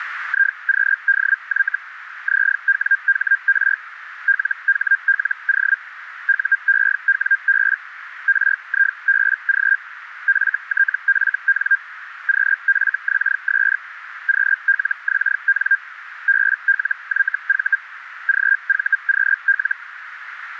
Hellschreiber (Feld-Hell, 122.5 baud), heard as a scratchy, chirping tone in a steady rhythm, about 1600 Hz, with radio static. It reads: IQDY ZWHR LHLO UEWB RIBG FTFN QFXS QLXN BLYV GVQL